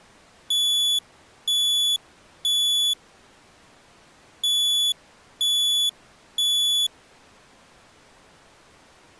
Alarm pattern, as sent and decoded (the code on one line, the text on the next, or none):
3 beeps and a pause
temporal three